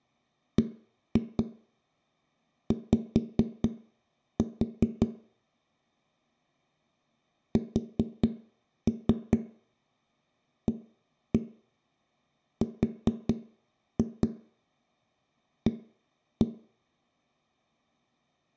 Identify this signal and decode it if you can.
Tap code, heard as knocks on a wall, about 4 knocks a second, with room echo. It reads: BY SARA